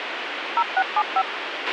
DTMF, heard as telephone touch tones, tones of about 60 ms, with radio hiss and a squelch burst at the end. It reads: 0675